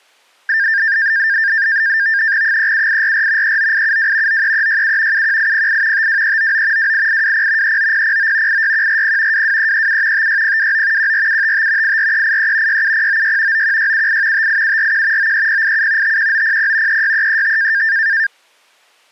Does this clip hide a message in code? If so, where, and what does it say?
Yes: NAVTEX (SITOR-B), 100 baud, 170 Hz shift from 0.5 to 18.3 s, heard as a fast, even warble, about 1700 Hz centre. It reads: 37844 39872 93367 71808 52399 28820 39009 86140 22337 56029 14755 84383 67096 91678 58741 93087 51900 36335